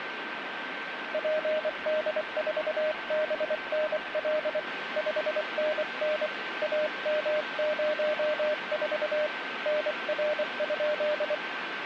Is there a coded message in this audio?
Yes: Morse code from 1.1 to 11.4 s, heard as a keyed tone, hand-sent with a paddle, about 24 wpm, 610 Hz, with radio static and a steady whistle near 1550 Hz. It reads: PD4BNL 5NN AM04 NR?